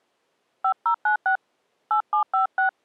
DTMF, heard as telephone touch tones, dialled by hand, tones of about 100 ms. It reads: 5096 8756